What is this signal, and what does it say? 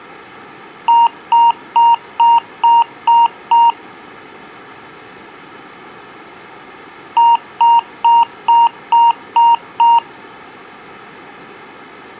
Beep code, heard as beeps from a small speaker, played twice, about 930 Hz. 7 short. In AMI BIOS tables: virtual mode exception error; in Dell tables: processor failure.